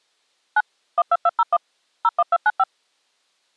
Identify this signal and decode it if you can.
DTMF, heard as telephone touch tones, dialled by machine, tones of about 40 ms. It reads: 9 12201 01295